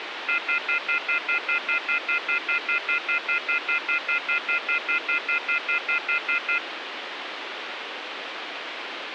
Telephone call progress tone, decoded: off-hook warning tone

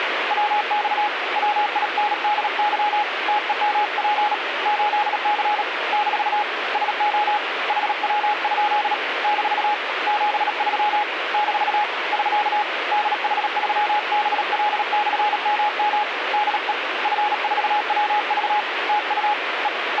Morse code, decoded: WX WINDY TEMP 8C - SO HW? - 73 - <SK> DH3BL/MM DE F4WV TU E …

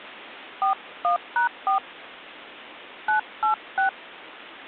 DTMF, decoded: 41#4 986

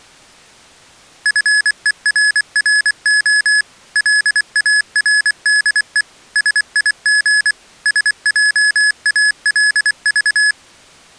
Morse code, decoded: FERRO LARDE SIG SJALV

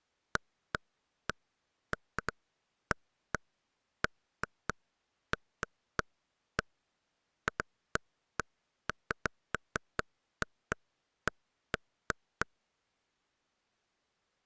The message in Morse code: none

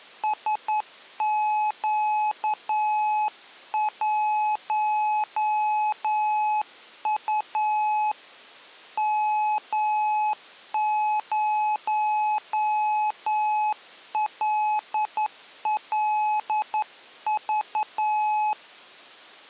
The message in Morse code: SQ1U M0LLV

